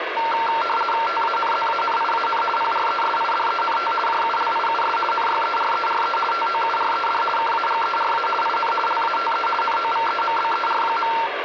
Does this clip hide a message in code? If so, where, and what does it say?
Yes: RTTY (50 baud, 450 Hz shift) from 0.2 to 11.3 s, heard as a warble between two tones, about 1140 Hz centre, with radio static and a steady whistle near 1960 Hz. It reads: TANZANIAN PRESIDENT JULIUS NYERERE TOURED KAGERA IN LATE NOVEMBER.